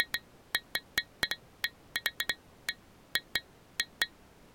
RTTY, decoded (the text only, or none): none